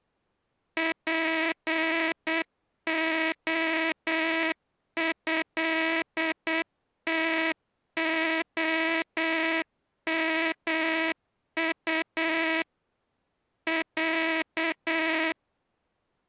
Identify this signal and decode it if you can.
Morse code (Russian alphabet), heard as a buzzer, machine-sent, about 8 wpm. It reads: ПОЭТОМУ Я